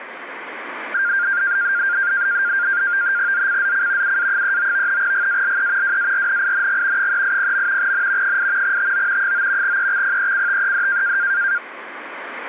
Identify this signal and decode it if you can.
NAVTEX (SITOR-B), 100 baud, 170 Hz shift, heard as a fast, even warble, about 1500 Hz centre, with radio static. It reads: ZCZC UA39 GALE WARNING 380. N 8 TO 9 EXPECTED